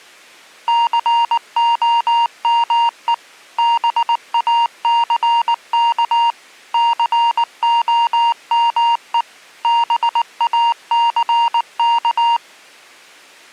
Morse code, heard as electronic beeps, machine-sent, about 19 wpm, 940 Hz. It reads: COME BACK COME BACK